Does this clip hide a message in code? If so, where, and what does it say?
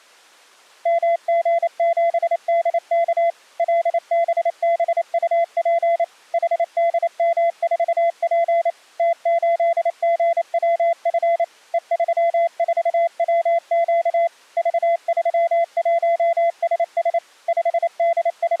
Yes: Morse code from 0.8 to 18.6 s, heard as a keyed tone, machine-sent, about 28 wpm, 680 Hz. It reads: MG7DK LBBUP HDM4P T8GWF E34WQ V31SS …